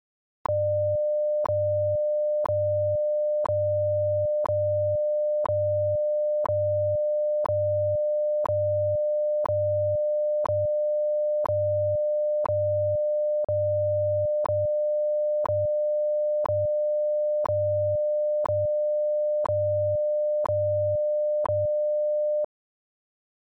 Radio time signal (WWV, Colorado), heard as ticks, one a second.